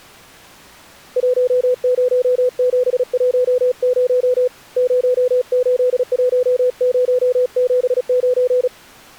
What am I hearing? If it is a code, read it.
Morse code, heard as a keyed tone, hand-sent with a paddle, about 36 wpm, 500 Hz. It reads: 10710 081079